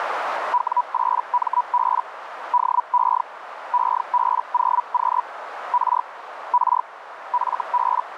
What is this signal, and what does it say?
Hellschreiber (Feld-Hell, 122.5 baud), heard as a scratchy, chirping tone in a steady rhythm, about 980 Hz, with radio static and a narrow filter. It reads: W8MB DE EB0Q R R FB